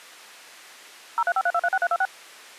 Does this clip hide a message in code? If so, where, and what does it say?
Yes: DTMF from 1.2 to 2.1 s, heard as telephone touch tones, dialled by machine, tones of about 50 ms. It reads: 0353236326